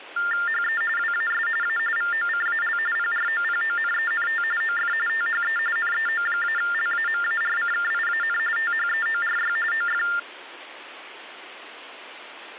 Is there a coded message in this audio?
Yes: TTY/TDD text telephone tones (45.45 baud Baudot) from 0.2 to 10.2 s, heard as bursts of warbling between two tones, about 400 Hz shift, 1600 Hz centre, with phone line noise. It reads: HE WAS A VOCAL PROPONENT OF THE NEO-LAMARCKIAN THEORY OF